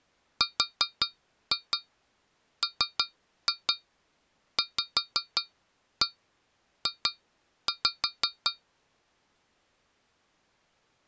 Tap code, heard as taps on a metal pipe, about 5 knocks a second. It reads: RMVJ